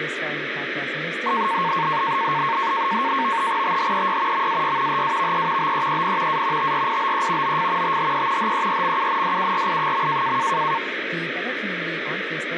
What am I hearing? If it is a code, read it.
NAVTEX (SITOR-B), 100 baud, 170 Hz shift, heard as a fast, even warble, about 1000 Hz centre, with radio static and speech in English. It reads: THEY MAY HAVE BEEN A TRIBE OF THE HERMUNDURI.